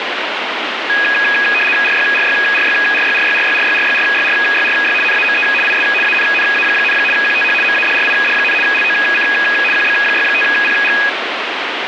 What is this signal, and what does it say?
RTTY (75 baud, 850 Hz shift), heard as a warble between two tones, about 2100 Hz centre, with radio static. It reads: RYRYRYRYRYRYRYRYRYRYRY NAME IS ANNA, QTH MADRID, LOC QB65PG